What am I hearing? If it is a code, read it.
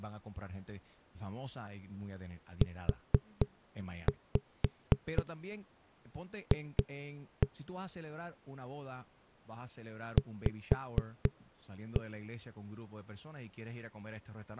Tap code, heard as knocks on a wall, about 4 knocks a second, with speech in Spanish. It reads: UF V